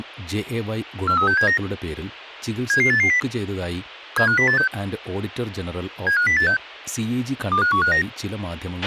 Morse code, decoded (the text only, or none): none